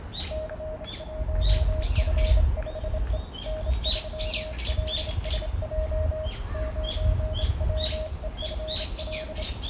Morse code, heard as a keyed tone, hand-sent with a straight key, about 27 wpm, 620 Hz, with radio static, a narrow filter and the noise of a residential street. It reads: C1F5E N3LSJ 9WEFL